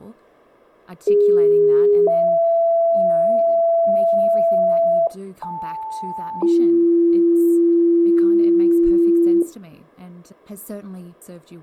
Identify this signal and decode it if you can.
Two-tone page, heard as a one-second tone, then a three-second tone, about 410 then 670 Hz, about 880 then 340 Hz, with speech in English.